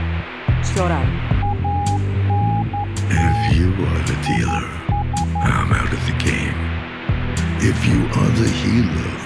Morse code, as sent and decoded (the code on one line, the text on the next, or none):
.- -. - / .. ...
ANT IS